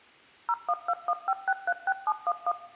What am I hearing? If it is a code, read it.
DTMF, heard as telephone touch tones, dialled by machine, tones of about 50 ms, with room echo. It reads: 01215636711